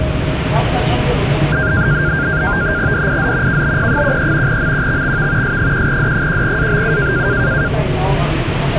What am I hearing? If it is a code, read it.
NAVTEX (SITOR-B), 100 baud, 170 Hz shift, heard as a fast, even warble, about 1500 Hz centre, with radio static and the noise inside a subway train. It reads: DIZ KBP13 MQXXV S1D1ABU